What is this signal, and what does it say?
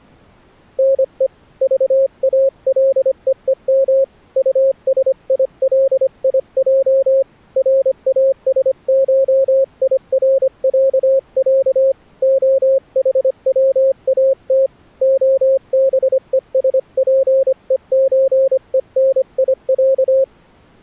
Morse code (Russian alphabet), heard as a keyed tone, hand-sent with a paddle, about 25 wpm, 540 Hz. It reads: НЕ ЖАЛЕЕМ УСИЛИЙ РАСШИРЯЯ ОХВАТ ОБЕСПЕЧЕНИЯ